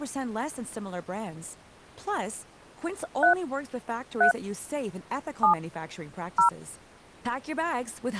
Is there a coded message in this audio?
Yes: DTMF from 3.2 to 6.5 s, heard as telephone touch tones, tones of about 110 ms, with speech in English. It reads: 3 3 7 0